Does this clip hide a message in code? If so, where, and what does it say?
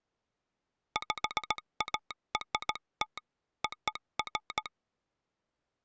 Yes: Morse code (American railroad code) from 0.9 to 4.7 s, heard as a telegraph sounder. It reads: PART OF